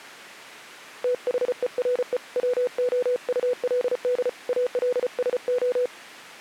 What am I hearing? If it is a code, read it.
Morse code, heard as a keyed tone, hand-sent with a paddle, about 34 wpm, 500 Hz. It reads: THERE WOULD ALSO